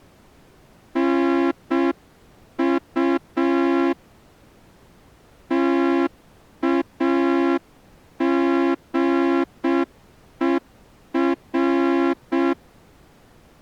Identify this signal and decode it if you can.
Morse code, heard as a horn, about 6 wpm. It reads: NU TAGER